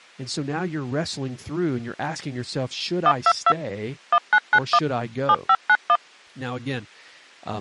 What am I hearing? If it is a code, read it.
DTMF, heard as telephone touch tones, dialled by machine, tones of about 60 ms, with speech in English. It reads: 122 1991 7591